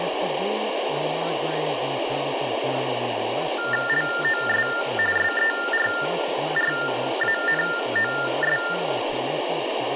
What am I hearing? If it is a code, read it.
TTY/TDD text telephone tones (45.45 baud Baudot), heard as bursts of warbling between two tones, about 400 Hz shift, 1600 Hz centre, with phone line noise, room echo and speech in English. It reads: LOS SERRANOS